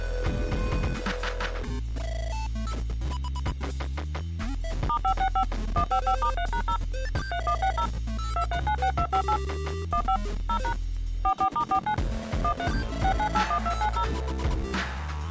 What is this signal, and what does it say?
DTMF, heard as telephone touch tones, dialled by machine, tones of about 80 ms. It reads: *565 155*3#0 3160 2396258 15 0# 44*49 13 6981290